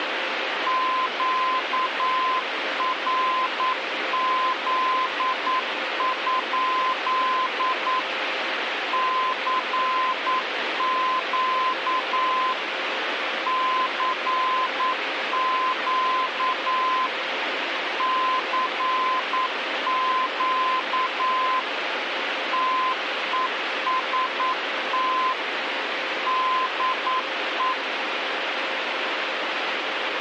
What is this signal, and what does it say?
Morse code, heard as a keyed tone, machine-sent, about 9 wpm, 1030 Hz, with radio static. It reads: QRZ? CQ CQ CQ TEST DE